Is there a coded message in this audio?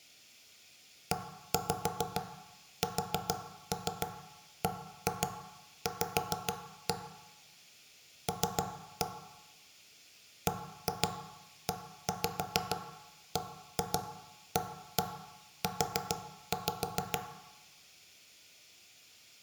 Yes: tap code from 1.1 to 17.3 s, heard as knocks on wood, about 6 knocks a second, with room echo. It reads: ESBV L BEBAU